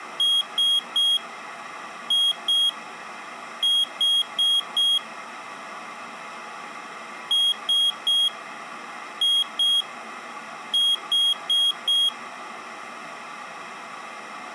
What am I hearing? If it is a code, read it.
Beep code, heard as a piezo beeper, played twice, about 3300 Hz. 3-2-4. In Phoenix BIOS tables: keyboard controller failure.